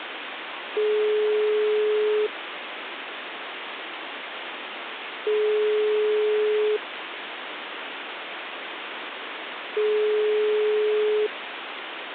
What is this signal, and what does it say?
Telephone call progress tone (single-tone plan, as in most of Europe), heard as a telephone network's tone, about 420 Hz, 1.5 s on and 3 s off, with phone line noise. Ringback tone.